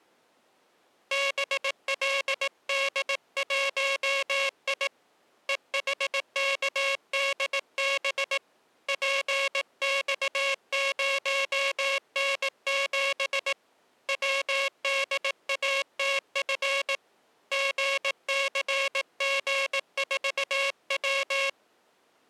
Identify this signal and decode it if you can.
Morse code, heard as a buzzer, hand-sent with a paddle, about 18 wpm. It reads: BLD1I EHKDB PX0N7 WDATF GCG4W